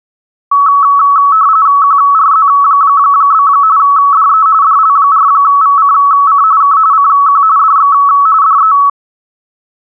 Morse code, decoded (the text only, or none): none